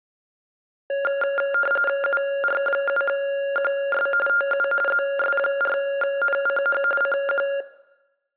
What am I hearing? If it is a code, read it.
RTTY (45.45 baud, 850 Hz shift), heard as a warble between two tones, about 980 Hz centre, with room echo. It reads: UR7QS TU ZS4NCH CQ